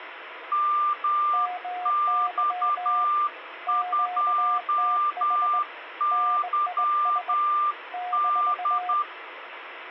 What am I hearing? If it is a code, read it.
Morse code, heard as two keyed tones, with radio static. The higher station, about 10 wpm, 1190 Hz: MX2YD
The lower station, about 20 wpm, 720 Hz: MY QTH NIS -